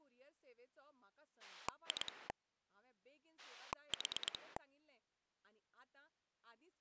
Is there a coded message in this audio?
Yes: pulse dialling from 1.4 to 4.6 s, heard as a rotary dial, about 9 pulses a second, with speech in Goan Konkani. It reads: 2 4